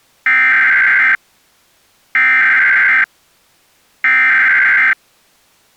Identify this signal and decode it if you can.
Emergency Alert System (SAME) tones (header bursts), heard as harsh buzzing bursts, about 520.83 baud.